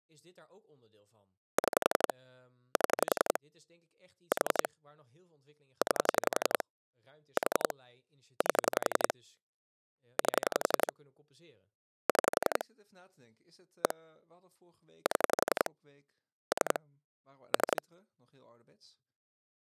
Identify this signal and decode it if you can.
Pulse dialling, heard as clicks on a phone line, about 11 pulses a second, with speech in Dutch. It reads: 6 7 4 9 4 8 8 6 1 7 3 3